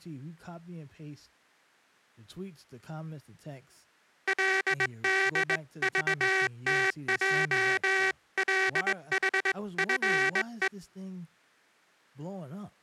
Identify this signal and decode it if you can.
Morse code (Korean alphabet), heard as a buzzer, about 20 wpm, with speech in English. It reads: 그렇구나